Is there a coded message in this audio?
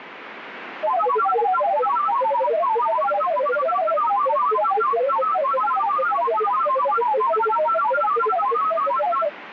Yes: multi-tone FSK (Olivia or MFSK type), about 1000 Hz wide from 0.8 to 9.3 s, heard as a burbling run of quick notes, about 31.25 baud, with radio static.